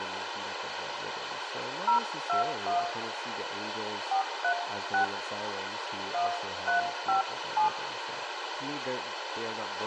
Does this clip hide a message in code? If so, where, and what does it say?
Yes: DTMF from 1.9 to 7.7 s, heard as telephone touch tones, dialled by hand, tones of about 110 ms, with radio hiss, a squelch burst at the end and speech in English. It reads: 021 436 1357